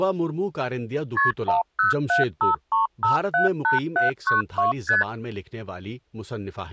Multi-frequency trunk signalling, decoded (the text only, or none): KP 10753578792 ST